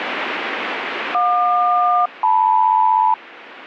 Aircraft SELCAL, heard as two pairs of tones, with radio static. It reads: JQ-LM